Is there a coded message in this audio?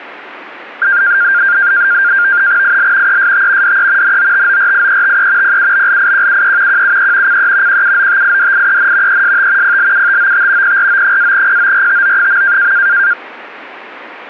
Yes: NAVTEX (SITOR-B), 100 baud, 170 Hz shift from 0.8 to 13.1 s, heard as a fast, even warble, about 1500 Hz centre. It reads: IL EST DE NOTORIETE PUBLIQUE QUE CE QUOTIDIEN EST PLUTOT PRO-PORTO.